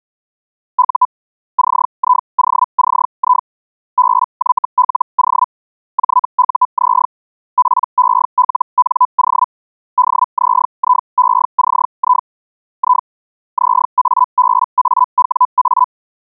Hellschreiber (Feld-Hell, 122.5 baud), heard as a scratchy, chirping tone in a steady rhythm, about 1000 Hz. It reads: U CIOCI BYLO JUZ PELNO DZIECI I ZABAWA